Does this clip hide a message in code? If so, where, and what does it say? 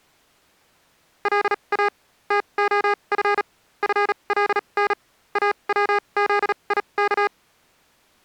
Yes: Morse code (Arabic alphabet) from 1.2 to 7.3 s, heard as electronic beeps, machine-sent, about 37 wpm, spaced as for 28 wpm, 410 Hz. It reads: لا تخف فلن اوذيك